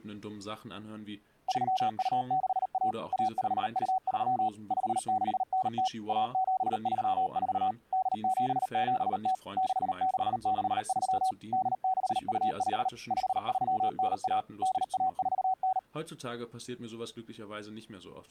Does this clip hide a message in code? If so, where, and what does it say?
Yes: Morse code (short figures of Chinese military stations) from 1.4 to 15.9 s, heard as a keyed tone, machine-sent, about 38 wpm, 750 Hz, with speech in German. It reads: 3261 1523 5690 1734 8770 6663 8625 5391 8149